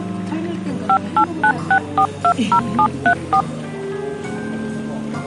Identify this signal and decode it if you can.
DTMF, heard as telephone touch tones, dialled by machine, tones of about 80 ms, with the noise of a cafe. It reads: 5896420734